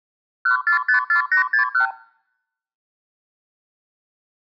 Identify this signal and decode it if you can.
Multi-frequency trunk signalling (R2, with the far end's replies), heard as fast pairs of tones, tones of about 110 ms. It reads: 1454861